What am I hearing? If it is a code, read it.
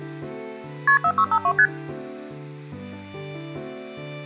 Multi-frequency trunk signalling (R1, as on North American trunks), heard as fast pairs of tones, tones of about 70 ms. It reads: KP 4652 ST